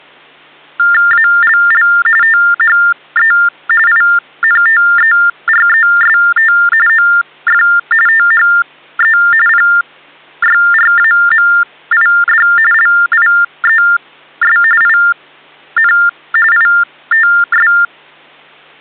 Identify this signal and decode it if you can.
TTY/TDD text telephone tones (45.45 baud Baudot), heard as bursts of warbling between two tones, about 400 Hz shift, 1600 Hz centre. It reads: ALL THE INTEREST OF THE PYRAMID LIES IN ITS